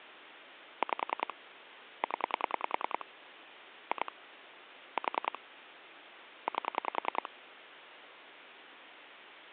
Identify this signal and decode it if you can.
Pulse dialling, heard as clicks on a phone line, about 10 pulses a second, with phone line noise. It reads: 5 0 2 4 8